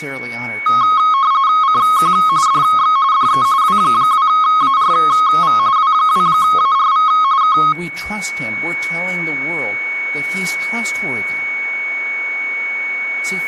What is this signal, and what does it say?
RTTY (45.45 baud, 170 Hz shift), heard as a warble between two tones, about 1180 Hz centre, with a steady whistle near 2230 Hz and speech in English. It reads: CQ DX DE W2ARV W2ARV K